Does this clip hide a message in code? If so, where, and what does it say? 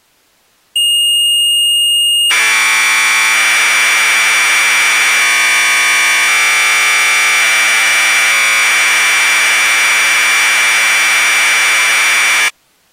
Yes: Commodore tape loading (standard loader) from 0.8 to 12.5 s, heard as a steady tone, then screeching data.